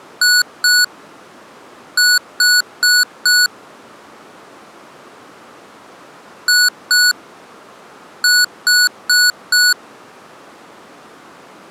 Beep code, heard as beeps from a small speaker, played twice, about 1470 Hz. 2-4.